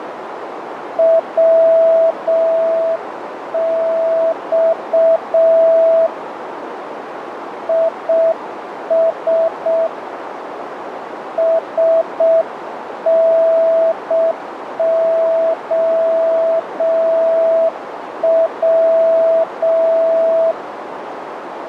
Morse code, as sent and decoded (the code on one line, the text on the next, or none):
.-- -..- / .. ... / ... -. --- .--
WX IS SNOW